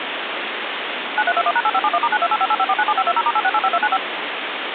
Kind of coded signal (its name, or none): DTMF